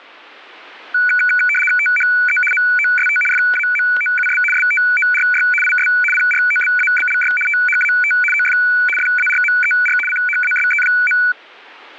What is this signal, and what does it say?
RTTY (75 baud, 850 Hz shift), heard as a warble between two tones, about 1900 Hz centre, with static crashes. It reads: THE MOST FAMOUS STORY IS PROBABLY THAT OF FARMER CHASE.